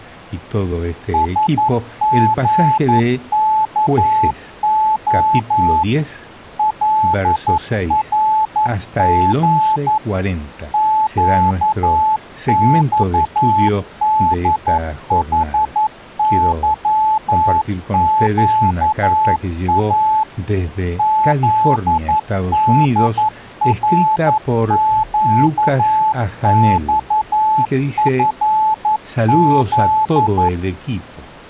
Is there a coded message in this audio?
Yes: Morse code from 1.1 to 30.5 s, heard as a keyed tone, machine-sent, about 11 wpm, 870 Hz. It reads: SGKO LRG QXDHYQA ZDRQXFZ